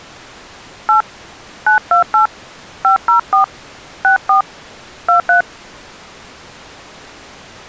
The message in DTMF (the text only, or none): 8 928 504 64 23